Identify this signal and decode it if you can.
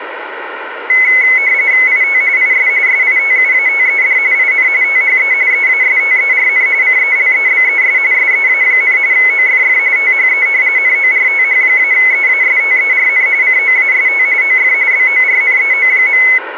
RTTY (45.45 baud, 170 Hz shift), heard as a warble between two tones, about 2100 Hz centre, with radio static. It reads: IT IS SITUATED IN THE EASTERN CELEBES SEA, OFF THE NORTH-EASTERN COAST OF BORNEO.